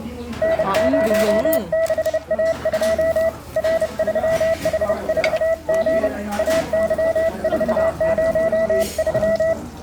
Morse code, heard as a keyed tone, hand-sent with a paddle, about 30 wpm, 660 Hz, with room echo and the noise of a restaurant. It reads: N06A2 R3H4G AY403